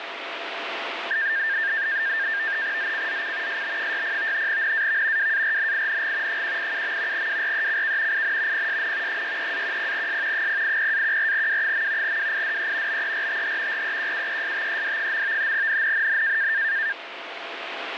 NAVTEX (SITOR-B), 100 baud, 170 Hz shift, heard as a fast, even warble, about 1700 Hz centre, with radio static. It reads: ZCZC SB60 NAV WARNING 187. WRECK IN PSN 63-10S 080-14W. WIDE BERTH REQUESTED. NNNN